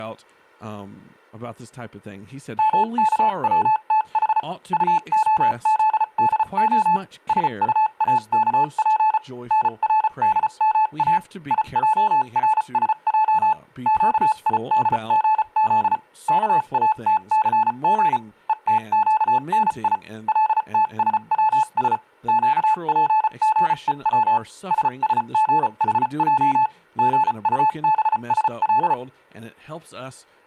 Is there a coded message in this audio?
Yes: Morse code (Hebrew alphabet) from 2.5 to 29.0 s, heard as a keyed tone, machine-sent, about 34 wpm, spaced as for 30 wpm, 870 Hz, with speech in English. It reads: מכצתח טהזדה שטאכף נרדמא יערשע קידגז כאתסג ותקני לתשצש קפגוץ ששגחע גטבשל